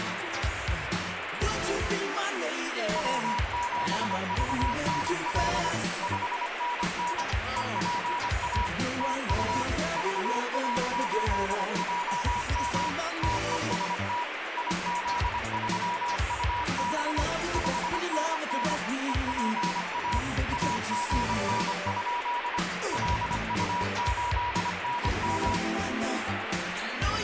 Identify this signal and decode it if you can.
Morse code, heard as a keyed tone, machine-sent, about 25 wpm, 970 Hz, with radio static. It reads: W7VNL 5NN EPA TU VA8JM TEST IZ3UB 5NN EPA AGN? LU8NM